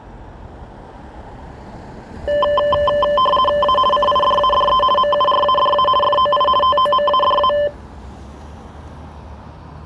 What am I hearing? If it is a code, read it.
RTTY (50 baud, 450 Hz shift), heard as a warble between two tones, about 810 Hz centre, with street noise. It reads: A CIDADE MURADA FOI TOMADA